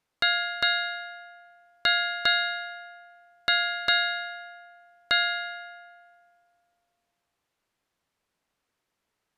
Ship's bell, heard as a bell. 7. Seven half-hours of the watch have passed.